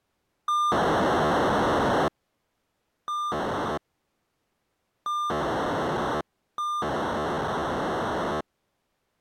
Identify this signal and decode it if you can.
POCSAG pager data (2400 baud), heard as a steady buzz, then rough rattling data.